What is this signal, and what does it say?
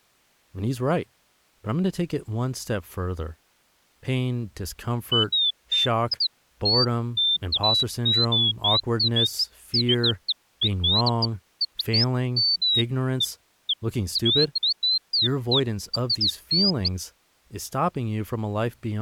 Bird-like chirps, with speech in English. There is no code.